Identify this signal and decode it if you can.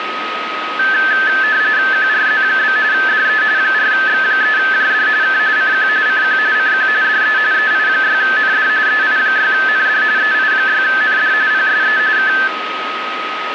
RTTY (45.45 baud, 170 Hz shift), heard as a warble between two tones, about 1650 Hz centre, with radio static and a steady whistle near 1260 Hz. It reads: QRZ? DE 4X3JD K CQ CQ CQ DE EI6ND EI6ND EI6ND PSE K